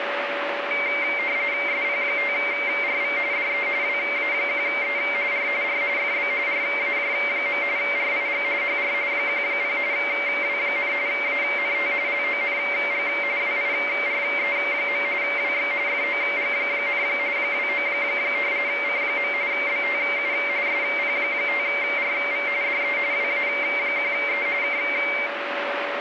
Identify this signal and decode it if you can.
RTTY (45.45 baud, 170 Hz shift), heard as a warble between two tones, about 2200 Hz centre, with radio static and a steady whistle near 570 Hz. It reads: SP5RV DE WA1E R R FB RAJ. RIG HR 10 W, ANT LONG WIRE. WX FOG, 29 C. BTU SP5RV DE WA1E K